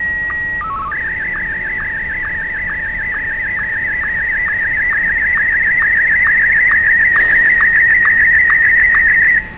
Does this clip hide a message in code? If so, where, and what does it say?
Yes: SSTV (slow-scan television), Martin M1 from 0.0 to 9.4 s, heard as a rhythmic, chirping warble, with radio static, fading, a steady whistle near 870 Hz, room echo and street noise.